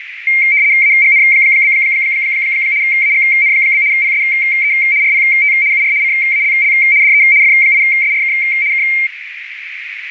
RTTY (75 baud, 170 Hz shift), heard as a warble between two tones, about 2200 Hz centre, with radio static and a narrow filter. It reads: AGN? AGN? PSE RPT UR CALL DE F8SRK K